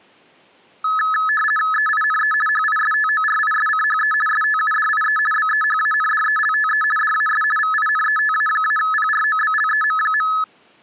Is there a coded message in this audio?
Yes: RTTY (50 baud, 450 Hz shift) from 0.8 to 10.4 s, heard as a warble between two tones, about 1500 Hz centre. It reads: EINE HISTORISCHE STUDIE BEHANDELTE DAS VINETA-PROBLEM.